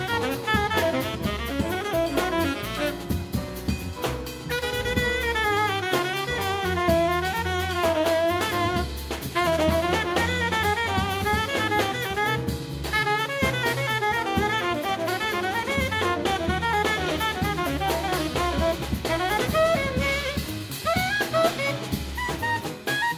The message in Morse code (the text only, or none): none